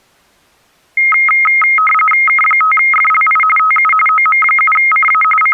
RTTY (45.45 baud, 850 Hz shift), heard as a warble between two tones, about 1700 Hz centre. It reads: K5FLI TU OM7CA …